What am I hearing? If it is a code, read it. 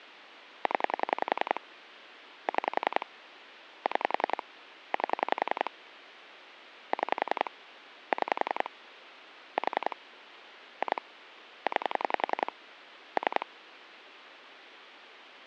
Pulse dialling, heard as clicks on a phone line, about 10 pulses a second, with phone line noise. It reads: 0 6 6 8 6 6 4 2 9 3